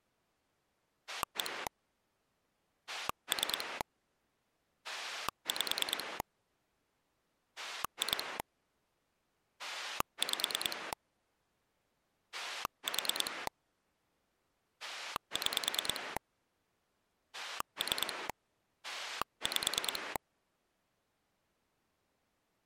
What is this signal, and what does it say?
Pulse dialling, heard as a rotary dial, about 9 pulses a second. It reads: 1 3 5 2 5 4 6 3 5